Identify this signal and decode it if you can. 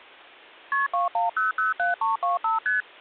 Multi-frequency trunk signalling (R1, as on North American trunks), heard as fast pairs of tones, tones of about 150 ms. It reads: KP 21007325 ST